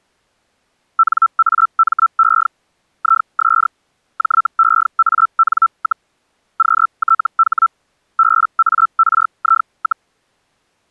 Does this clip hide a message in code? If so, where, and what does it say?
Yes: Hellschreiber (Feld-Hell, 122.5 baud) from 1.0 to 10.1 s, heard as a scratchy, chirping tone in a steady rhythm, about 1330 Hz. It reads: NAME IS JEAN, QTH BARI,